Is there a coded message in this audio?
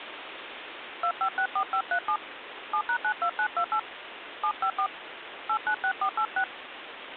Yes: DTMF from 1.0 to 6.4 s, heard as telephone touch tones, dialled by hand, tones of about 80 ms, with phone line noise. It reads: 2564537 7#92928 754 896486